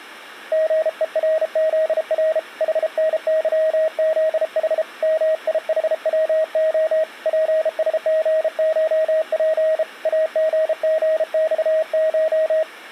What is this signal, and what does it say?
Morse code (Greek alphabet), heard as a keyed tone, hand-sent with a bug key, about 33 wpm, 630 Hz. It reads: ΓΕΡΖΡ ΗΝΥΖΗ ΜΙΗΩΟ ΠΣΓΧΠ ΑΓΓΞΧ